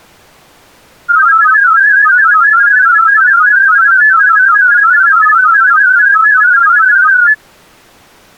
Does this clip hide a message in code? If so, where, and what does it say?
Yes: multi-tone FSK (Olivia or MFSK type), about 500 Hz wide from 1.1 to 7.4 s, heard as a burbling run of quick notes, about 31.25 baud.